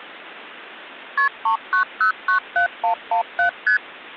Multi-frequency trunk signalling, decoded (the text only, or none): KP 39097117 ST